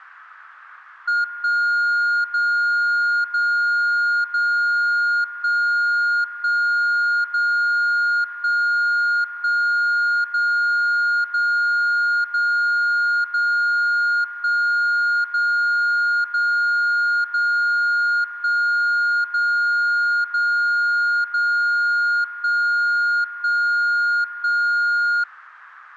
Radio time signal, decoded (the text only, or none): 1 0 0 0 1 1 0 1 1 0 0 0 0 1 0 0 0 1 0 0 0 1 1 1